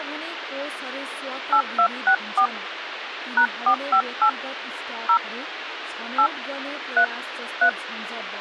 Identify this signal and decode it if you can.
DTMF, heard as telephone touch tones, dialled by hand, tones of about 80 ms, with radio hiss and speech in Nepali. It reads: 8264 #458 0 8 3 3